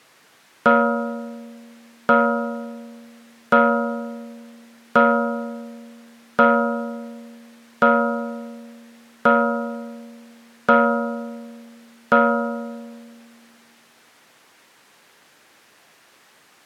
Clock strike, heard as a bell. 9. Nine o'clock.